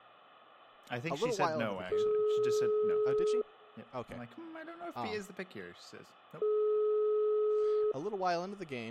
Telephone call progress tone (single-tone plan, as in most of Europe), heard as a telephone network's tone, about 420 Hz, 1.5 s on and 3 s off, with speech in English. Ringback tone.